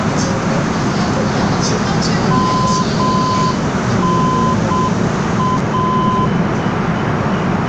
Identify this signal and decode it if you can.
Morse code, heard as a keyed tone, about 7 wpm, 1020 Hz, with radio static, a narrow filter and the noise inside a subway train. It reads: MNA